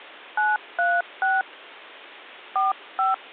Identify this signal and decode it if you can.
DTMF, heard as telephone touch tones, dialled by hand, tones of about 170 ms. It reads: 936 45